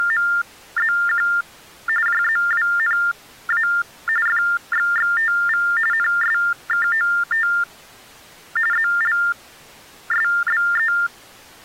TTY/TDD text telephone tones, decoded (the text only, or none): … JZWNA FXXTV NSKOT ZLSBE